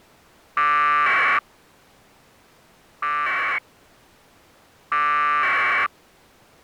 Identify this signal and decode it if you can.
Packet radio (AX.25, as in APRS), 1200 baud, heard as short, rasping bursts.